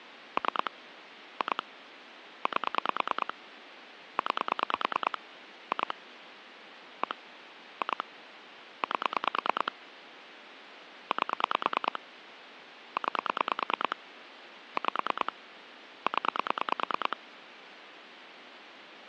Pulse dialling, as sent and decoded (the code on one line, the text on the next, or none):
3 / 2 / 8 / 9 / 2 / 1 / 2 / 8 / 8 / 9 / 5 / 10
3 2 8 9 2 1 2 8 8 9 5 0